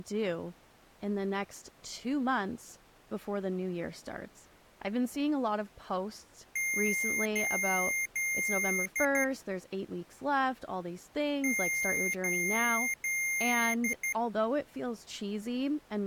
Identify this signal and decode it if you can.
Beep code, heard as beeps from a small speaker, played twice, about 2100 Hz, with speech in English. 3 long, 2 short.